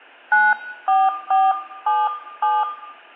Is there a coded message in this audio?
Yes: DTMF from 0.3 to 2.6 s, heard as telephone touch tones, dialled by hand, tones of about 210 ms, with room echo. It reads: 94477